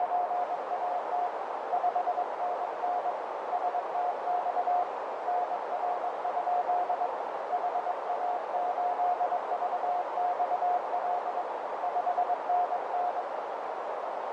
Morse code, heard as a keyed tone, hand-sent with a straight key, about 22 wpm, 720 Hz, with heavy radio static and a narrow filter. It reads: … 5NN STX NR? HA8VXL 5NN